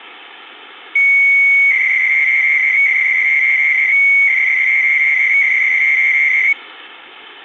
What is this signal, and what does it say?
300-baud modem data (Bell 103 tones), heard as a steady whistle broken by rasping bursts, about 300 baud, 200 Hz shift, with phone line noise.